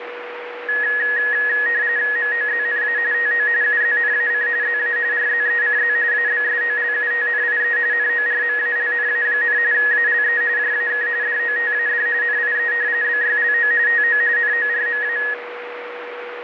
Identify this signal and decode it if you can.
RTTY (45.45 baud, 170 Hz shift), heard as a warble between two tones, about 1800 Hz centre, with radio static and a steady whistle near 480 Hz. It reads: MOZNA TO UZNAC ZA RZECZ ABSOLUTNIE NORMALNA, ALE JAK DOTAD NIE BYLO TO NORMA